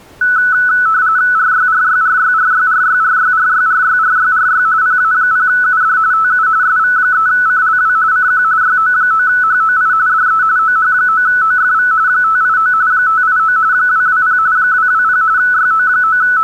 RTTY (45.45 baud, 170 Hz shift), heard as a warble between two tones, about 1400 Hz centre. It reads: RYRYRYRYRYRYRYRYRYRY PA0UD TU SV3CLW CQ YO9HOI DE OH9OFV 589 589 220 220 …